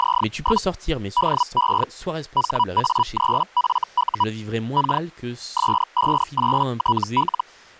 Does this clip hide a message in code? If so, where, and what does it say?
Yes: Hellschreiber (Feld-Hell, 122.5 baud) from 0.0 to 7.4 s, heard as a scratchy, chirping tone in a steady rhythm, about 980 Hz, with speech in French. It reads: … DE HA3FU K S58TL